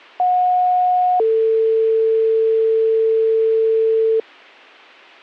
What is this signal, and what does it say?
Two-tone page, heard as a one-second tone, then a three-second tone, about 730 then 450 Hz.